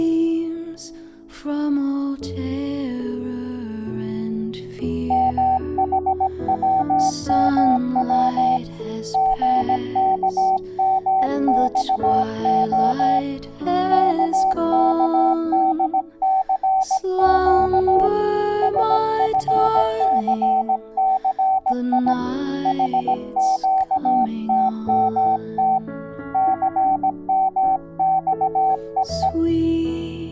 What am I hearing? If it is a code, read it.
Morse code, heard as a keyed tone, hand-sent with a paddle, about 17 wpm, 760 Hz. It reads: MHWMW GKMXO KKDCQ SFCCI HQTMT CMXEE